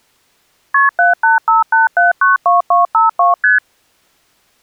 Multi-frequency trunk signalling (R1, as on North American trunks), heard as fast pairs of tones, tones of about 150 ms. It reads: KP 7858792252 ST